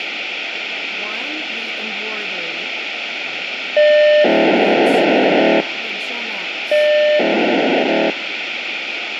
POCSAG pager data (1200 baud), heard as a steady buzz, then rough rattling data, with radio hiss.